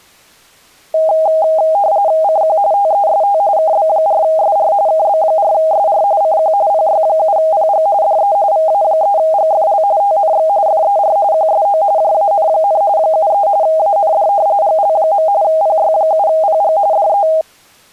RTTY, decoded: CQ TEST KB4SR KB4SR CQ PY7PG DE VA3GFL TNX FER QSO JAN, 73 AND GL. PY7PG DE

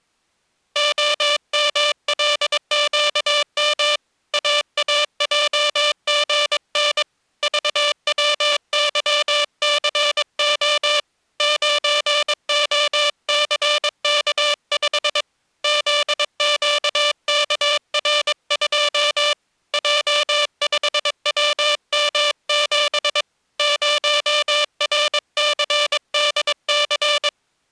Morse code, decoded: OMLQM AAJGN VWYCO 9OCK5 ZQKR2 J5WM7 0RCDC

